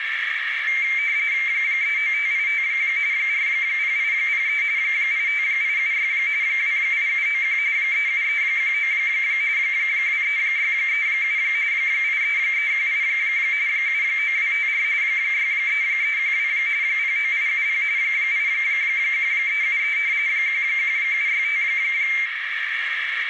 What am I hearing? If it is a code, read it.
RTTY (45.45 baud, 170 Hz shift), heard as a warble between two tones, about 2200 Hz centre, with radio static and a narrow filter. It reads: 39585 40803 85876 28791 37319 23637 83318 79254 63312 09870 81373 11765